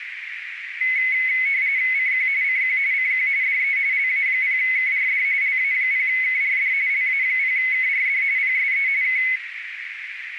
RTTY (45.45 baud, 170 Hz shift), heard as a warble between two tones, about 2100 Hz centre, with radio static and a narrow filter. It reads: CQ CQ CQ DE LA0KRD LA0KRD LA0KRD PSE K